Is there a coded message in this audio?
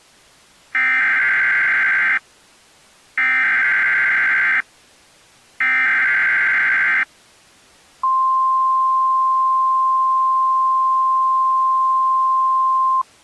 Yes: Emergency Alert System (SAME) tones (header bursts, then the 1050 Hz attention tone) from 0.7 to 13.0 s, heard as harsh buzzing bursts, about 520.83 baud.